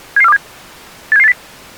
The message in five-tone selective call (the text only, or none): 77427 87780